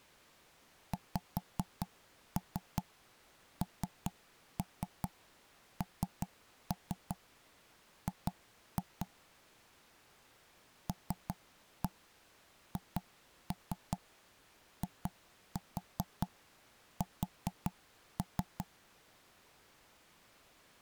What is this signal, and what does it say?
Tap code, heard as knocks on wood, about 5 knocks a second. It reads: XNNG LHIS